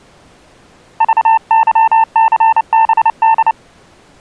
Morse code, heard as a keyed tone, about 29 wpm, 900 Hz. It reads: VYCBD